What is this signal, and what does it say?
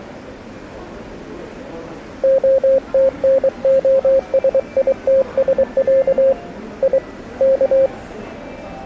Morse code (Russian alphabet), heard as a keyed tone, hand-sent with a paddle, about 23 wpm, 540 Hz, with the noise of a subway station. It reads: ОТНОСИТСЯ И К